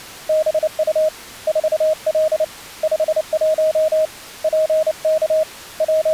Morse code, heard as a keyed tone, hand-sent with a paddle, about 29 wpm, 630 Hz. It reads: BU 4L 51 PK …